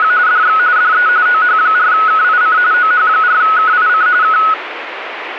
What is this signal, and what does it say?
RTTY (45.45 baud, 170 Hz shift), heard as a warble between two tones, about 1370 Hz centre, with radio static. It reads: … DX DE OH4KIC OH4KIC K